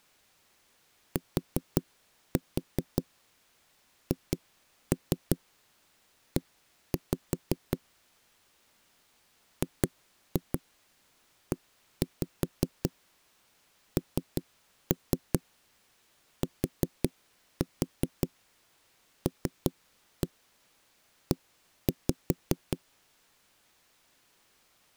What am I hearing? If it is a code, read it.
Tap code, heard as knocks on wood, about 5 knocks a second. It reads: THE GENTLE